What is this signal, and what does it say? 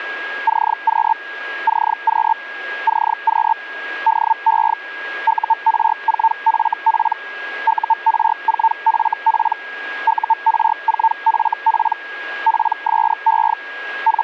Hellschreiber (Feld-Hell, 122.5 baud), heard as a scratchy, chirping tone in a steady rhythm, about 900 Hz, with a steady whistle near 1640 Hz. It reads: CQ CQ CQ DE UR4FP UR4FP UR4FP PSE …